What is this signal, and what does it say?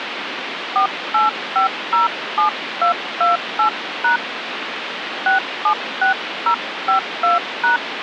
DTMF, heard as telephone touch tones, dialled by hand, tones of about 120 ms, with phone line noise. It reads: 48507228# 676052#